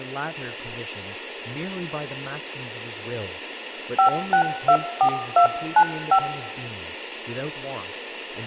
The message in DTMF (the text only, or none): 5624295